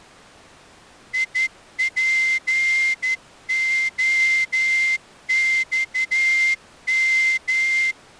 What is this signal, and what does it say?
Morse code, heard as a whistle, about 12 wpm. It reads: IPOXM